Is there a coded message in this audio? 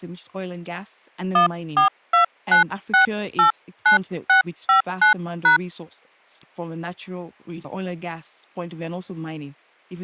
Yes: DTMF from 1.4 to 5.6 s, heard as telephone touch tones, dialled by hand, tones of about 120 ms, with speech in English. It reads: 1429689659#